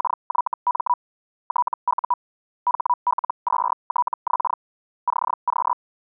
Hellschreiber (Feld-Hell, 122.5 baud), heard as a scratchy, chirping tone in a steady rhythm, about 980 Hz. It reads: … TU HL2TX CQ